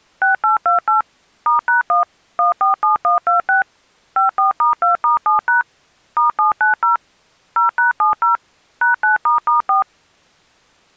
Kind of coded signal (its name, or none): DTMF